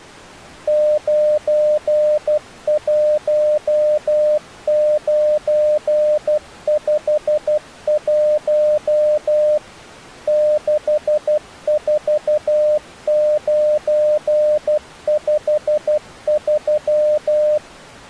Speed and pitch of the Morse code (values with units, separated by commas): 12 wpm, 600 Hz